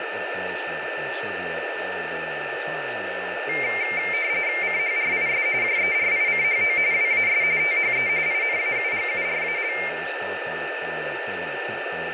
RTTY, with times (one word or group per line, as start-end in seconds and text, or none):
4.6-5.5 CHRIS
5.6-6.8 JERICHO
6.9-7.4 WAS
7.6-8.1 THE
8.3-9.7 INAUGURAL